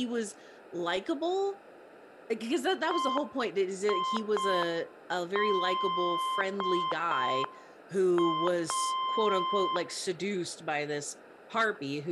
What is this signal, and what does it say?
Morse code (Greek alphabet), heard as a keyed tone, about 5 wpm, 1040 Hz, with room echo and speech in English. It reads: ΕΙΔΑ